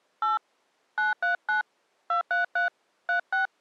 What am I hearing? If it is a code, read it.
DTMF, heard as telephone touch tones, dialled by hand, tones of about 140 ms. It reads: 8 939 233 36